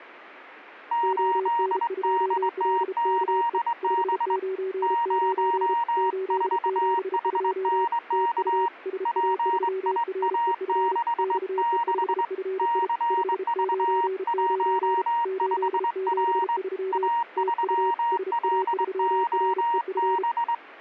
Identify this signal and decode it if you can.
Morse code, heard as two keyed tones. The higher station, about 22 wpm, 940 Hz: 8DTZB 04HNK PIA66 CV15R A3LOB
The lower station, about 33 wpm, 380 Hz: ON2LKE 599 872 TU SA3REF XE5FI 599 873 TU SA3REF